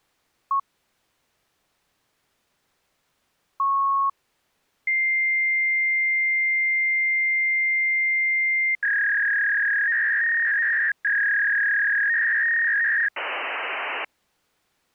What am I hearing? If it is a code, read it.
Fax machine handshake, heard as a beep, a long tone, a warble and hiss.